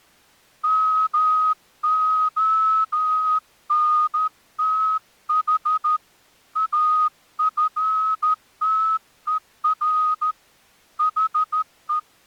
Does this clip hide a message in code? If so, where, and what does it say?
Yes: Morse code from 0.6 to 12.1 s, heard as a whistle, hand-sent with a straight key, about 13 wpm. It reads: MONTH AFTER HE